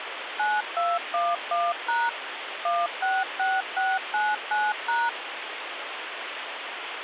DTMF, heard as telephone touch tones, dialled by machine, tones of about 210 ms, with phone line noise. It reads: 9211# 166699#